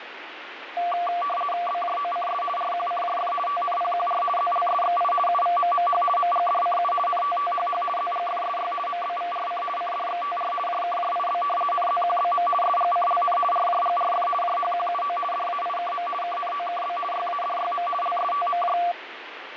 RTTY (50 baud, 450 Hz shift), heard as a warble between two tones, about 920 Hz centre, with radio static. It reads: BJOCS RQCJF TNPQR ZLSXI UVMMH MGDCU NTTHH ZGFSY MBVRC CDXTR JKJIB NZQBM SGCLN RJGRF JHQUO DAIKM KNOKB YADYM LSTMJ